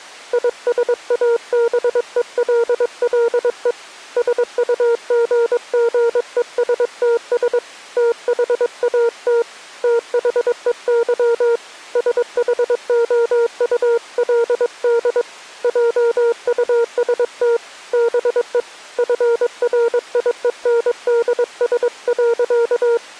Morse code, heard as a keyed tone, hand-sent with a paddle, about 22 wpm, 460 Hz. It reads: ISABELLE SUGGESTS THAT THEY SHOULD JUST BE FRIENDS.